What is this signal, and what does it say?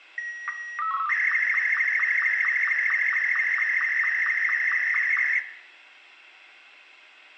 SSTV (slow-scan television), Martin M2, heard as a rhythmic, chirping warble, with a squelch burst at the end and room echo.